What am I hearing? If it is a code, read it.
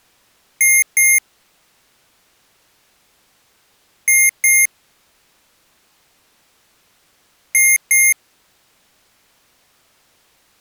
Beep code, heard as beeps from a small speaker, played three times, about 2100 Hz. 2 short. In AMI BIOS tables: memory parity error; in IBM BIOS tables: self-test error shown on screen; in Dell tables: no memory detected.